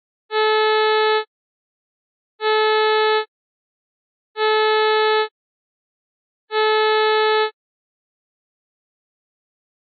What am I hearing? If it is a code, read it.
Ship horn signal, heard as a ship's horn, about 430 Hz. 4 short. At sea: a pilot vessel's identity signal in fog.